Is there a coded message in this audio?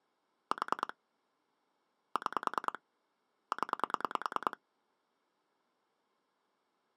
Yes: pulse dialling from 0.5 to 4.5 s, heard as clicks on a phone line, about 10 pulses a second. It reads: 4 6 0